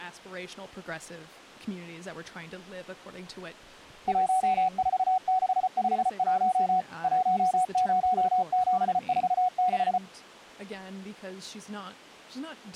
Morse code, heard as a keyed tone, machine-sent, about 34 wpm, 740 Hz, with speech in English. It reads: 14651 10746